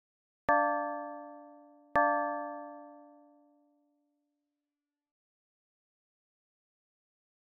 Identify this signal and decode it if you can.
Clock strike, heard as a bell. 2. Two o'clock.